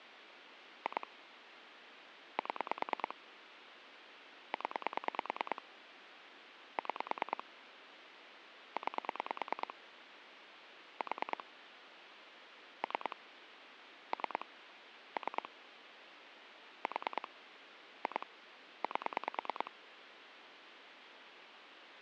Pulse dialling, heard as clicks on a phone line, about 9 pulses a second, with phone line noise. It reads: 2 7 0 6 9 4 3 3 3 4 2 8